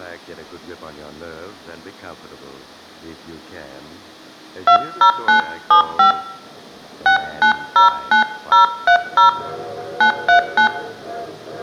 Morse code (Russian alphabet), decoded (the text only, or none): none